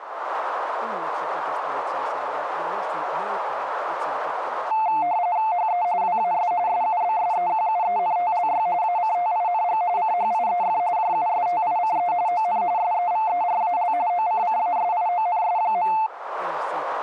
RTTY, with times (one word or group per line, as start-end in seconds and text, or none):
5.5-5.8 HE
6.0-6.5 WAS
6.7-8.7 SUBSEQUENTLY
8.8-9.8 ACTING
10.0-10.8 CHIEF
11.0-12.1 JUSTICE
12.3-12.6 ON
12.8-13.9 SEVERAL
14.1-15.9 OCCASIONS.